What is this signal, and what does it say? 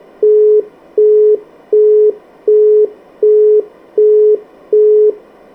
Telephone call progress tone (as in the UK, Australia and similar networks), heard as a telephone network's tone, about 420 Hz, 0.375 s on and 0.375 s off. Busy tone.